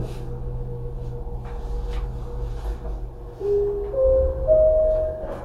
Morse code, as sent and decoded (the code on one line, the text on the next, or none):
none